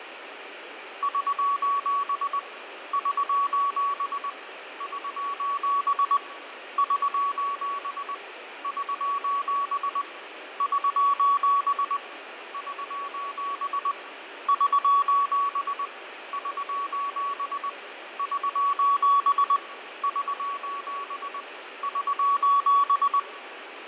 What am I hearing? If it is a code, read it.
Morse code, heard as a keyed tone, hand-sent with a paddle, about 20 wpm, 1130 Hz, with radio static and fading. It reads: <SOS> <SOS> <SOS> <SOS> <SOS> <SOS> <SOS> <SOS> <SOS> <SOS> <SOS> <SOS>